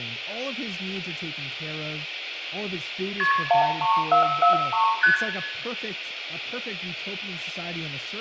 Multi-frequency trunk signalling (R1, as on North American trunks), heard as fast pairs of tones, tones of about 110 ms, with room echo and speech in English. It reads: KP 13443 ST